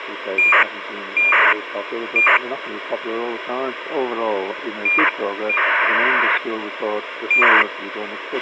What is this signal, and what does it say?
ACARS aircraft data, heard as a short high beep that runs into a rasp, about 2400 baud, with radio hiss and a squelch burst at the end.